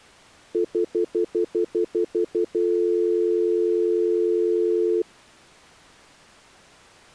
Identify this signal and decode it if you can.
Telephone call progress tone (North American plan), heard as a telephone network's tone, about 350, 440 Hz, 0.1 s on and 0.1 s off. Stutter dial tone.